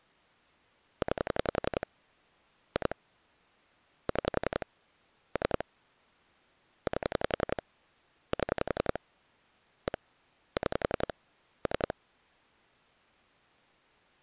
Pulse dialling, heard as clicks on a phone line, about 11 pulses a second. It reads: 9 2 6 3 8 7 1 6 3